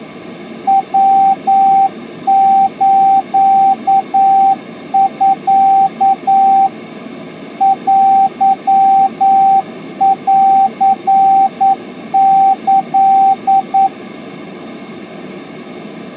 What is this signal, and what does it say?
Morse code (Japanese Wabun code), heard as a keyed tone, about 9 wpm, 780 Hz. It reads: ヤスミ テンキ